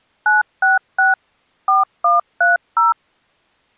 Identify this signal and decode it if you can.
DTMF, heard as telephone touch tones, dialled by machine, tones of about 160 ms. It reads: 966 4130